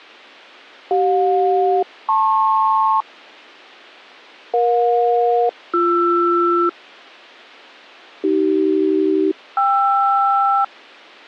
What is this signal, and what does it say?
Aircraft SELCAL, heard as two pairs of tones. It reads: CJ-LP EJ-BR AC-KR